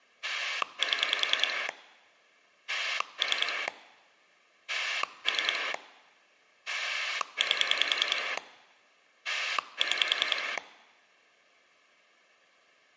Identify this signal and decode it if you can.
Pulse dialling, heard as a rotary dial, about 10 pulses a second. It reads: 7 3 3 8 6